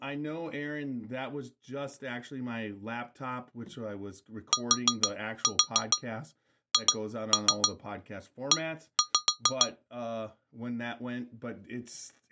Tap code, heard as taps on glass, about 6 knocks a second, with speech in English. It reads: THE